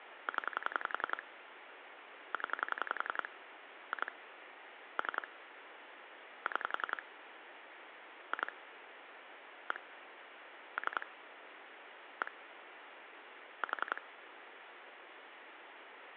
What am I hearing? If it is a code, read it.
Pulse dialling, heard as clicks on a phone line, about 11 pulses a second, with phone line noise. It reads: 0 0 2 3 6 2 1 3 1 4